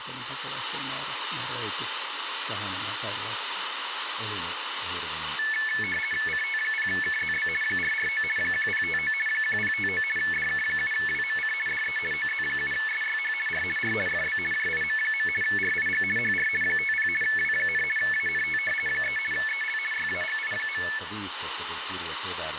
RTTY (50 baud, 450 Hz shift), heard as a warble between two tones, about 2000 Hz centre, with radio static and speech in Finnish. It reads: CT0KZB 449 1059 1059 DK7WMC DE OZ7SYH R R FB JIM. RIG HR 50 W, ANT 3 EL YAGI.